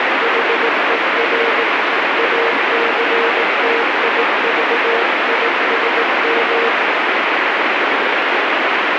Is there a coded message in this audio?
Yes: Morse code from 0.2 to 6.7 s, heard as a keyed tone, hand-sent with a paddle, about 18 wpm, 460 Hz, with heavy radio static. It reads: HER ACTIVISM